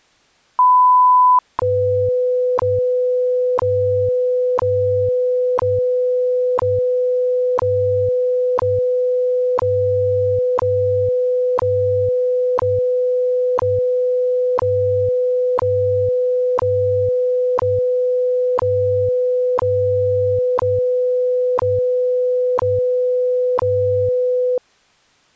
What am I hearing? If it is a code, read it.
Radio time signal (WWV, Colorado), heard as ticks, one a second.